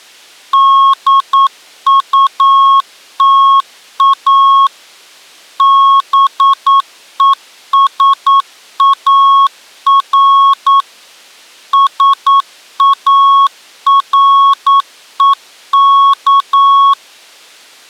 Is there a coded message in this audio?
Yes: Morse code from 0.5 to 17.0 s, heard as a keyed tone, machine-sent, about 9 wpm, 1100 Hz. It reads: DUTA BESAR SAREK